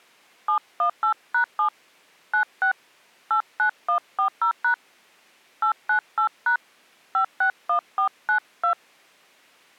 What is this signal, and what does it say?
DTMF, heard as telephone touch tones, dialled by hand, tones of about 100 ms. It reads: 718#7 96 89140# 898# 561492